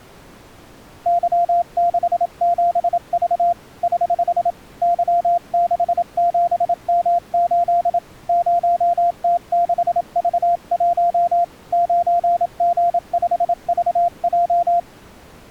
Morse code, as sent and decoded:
-.-- -.... --... ...- / ........ / -.-- -.... --... -- ---.. / ----- - -.... ...- .---- / ----. --. ..... ...- .---
Y67V <HH> Y67M8 0T6V1 9G5VJ

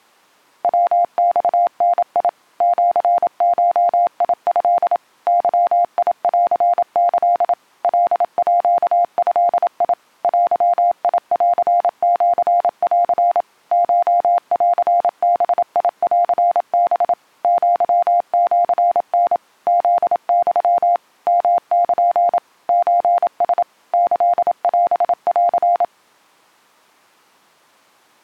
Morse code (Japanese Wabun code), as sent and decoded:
.-- -..- -. .. / --.-. ---- .. ..-.. / -.-- .. .-.-. -.-.. / .-.. .--.- ..-.. .. / .-.-- .. .-.-. --.-. .-.-. / ---- .-.-. -... .. .-.-. -... / --.-- --.-. -. / --.. -..-- / -- -.--. / ---. ... / -.-.. .-... .-.-.
ヤマダ シゴト ゲンキ カード デンシン コンバンハ アシタ フユ ヨル ソラ キオン

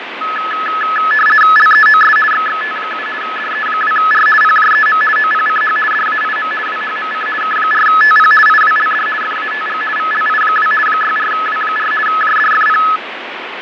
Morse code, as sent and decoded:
none

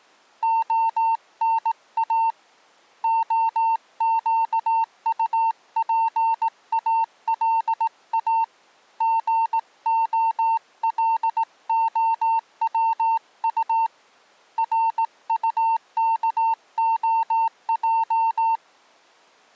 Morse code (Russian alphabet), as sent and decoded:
--- -. .- / --- --.- ..- .--. .- .-.. .- / --. --- .-.. --- .-- ..- / .-. ..- -.- --- .---
ОНА ОЩУПАЛА ГОЛОВУ РУКОЙ

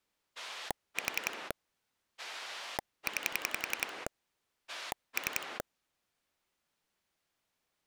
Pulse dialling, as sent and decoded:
4 / 9 / 3
4 9 3

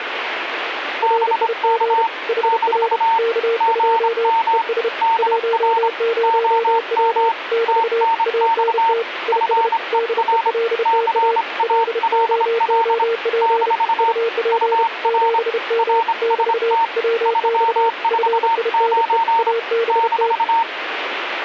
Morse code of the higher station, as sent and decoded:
-... -.- / -....- / --. -- / -.. .-. / --- -- / - -. -..- / ..-. . .-. / -.-. .- .-.. .-.. / -....- / ..- .-. / .-. ... - / ...-- ....- ----. / -....-
BK - GM DR OM TNX FER CALL - UR RST 349 -

